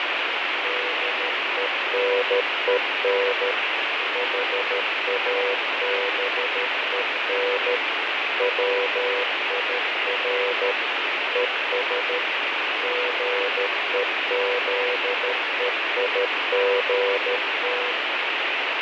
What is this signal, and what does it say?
Morse code, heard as a keyed tone, machine-sent, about 13 wpm, 490 Hz, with heavy radio static and fading. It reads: DENEN HABEN WIR ES GEZEIGT